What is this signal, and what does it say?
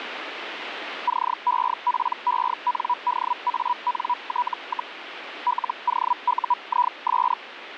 Hellschreiber (Feld-Hell, 122.5 baud), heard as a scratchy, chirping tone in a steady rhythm, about 980 Hz, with radio static. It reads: CEPENDANT, LOUIS